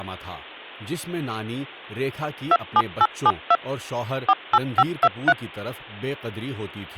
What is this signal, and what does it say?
DTMF, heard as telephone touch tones, dialled by machine, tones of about 50 ms, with speech in Urdu. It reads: 27872 48523